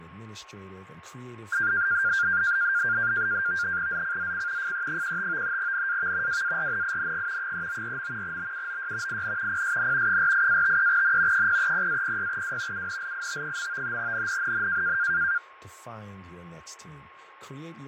NAVTEX (SITOR-B), 100 baud, 170 Hz shift, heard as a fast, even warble, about 1500 Hz centre, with radio static, fading, a steady whistle near 1080 Hz and speech in English. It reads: ZCZC FE15 NAV WARNING 394. BUOY IN PSN 48-53N 030-06W UNLIT. NNNN